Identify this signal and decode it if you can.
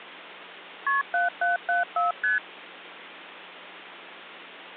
Multi-frequency trunk signalling (R1, as on North American trunks), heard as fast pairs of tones, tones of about 150 ms. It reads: KP 7774 ST